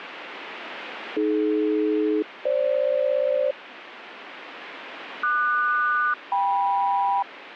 Aircraft SELCAL, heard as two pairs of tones, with radio static. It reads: AD-FG QS-KM